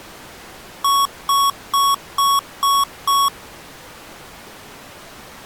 Beep code, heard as beeps from a small speaker, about 1110 Hz. 6 short. In AMI BIOS tables: keyboard controller gate A20 failure; in Dell tables: video card failure.